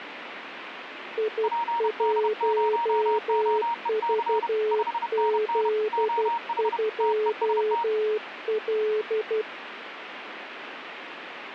Morse code, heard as two keyed tones, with radio static. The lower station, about 12 wpm, 430 Hz: I1VZ2L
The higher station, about 31 wpm, 940 Hz: PD0OEC 5NN OH TEST